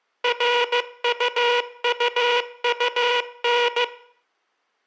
Morse code, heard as a buzzer, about 15 wpm. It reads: RUUUN